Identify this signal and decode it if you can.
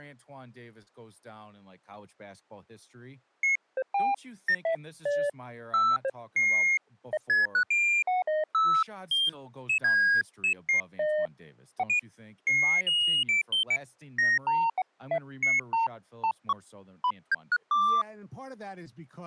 Electronic bleeps of random pitch and length, with speech in English. There is no code.